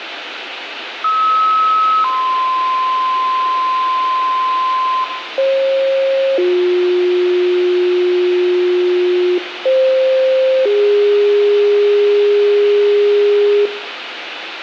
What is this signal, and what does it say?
Two-tone page, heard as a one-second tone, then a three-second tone, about 1290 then 1040 Hz, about 540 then 360 Hz, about 520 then 410 Hz, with radio hiss, a squelch burst at the end and room echo.